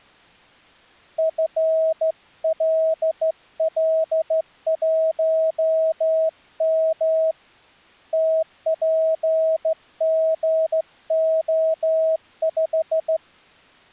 Morse code, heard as a keyed tone, hand-sent with a straight key, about 14 wpm, 640 Hz. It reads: FLL1M TPGO5